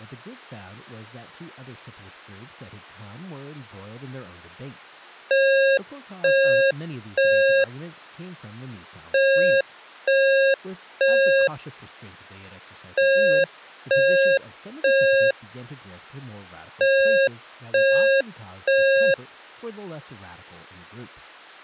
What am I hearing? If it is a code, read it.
Alarm pattern, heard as an alarm's beeps, played four times, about 540 Hz, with speech in English. Temporal three. Smoke or fire, evacuate.